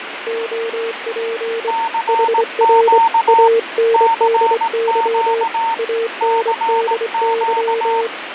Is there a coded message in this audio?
Yes: Morse code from 0.2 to 8.1 s, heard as two keyed tones, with radio static and fading. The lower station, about 24 wpm, 460 Hz: OP HR ANDY ANDY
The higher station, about 18 wpm, 910 Hz: CQ CQ CQ